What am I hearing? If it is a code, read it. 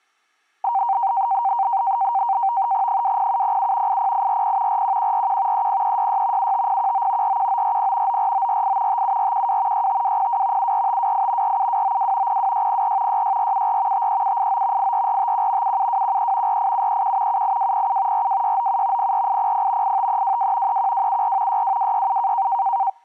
NAVTEX (SITOR-B), 100 baud, 170 Hz shift, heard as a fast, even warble, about 860 Hz centre. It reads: 20707 80840 41141 30366 75019 41940 94948 57412 65202 74528 47292 02604 66474 53789 84451 77213 48731 78207 42697 04800 85322 31274 62267